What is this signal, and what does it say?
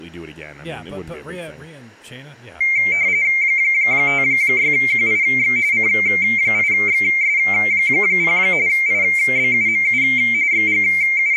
RTTY (45.45 baud, 170 Hz shift), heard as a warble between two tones, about 2200 Hz centre, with speech in English. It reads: 56QIX C8XS0 IBUMU …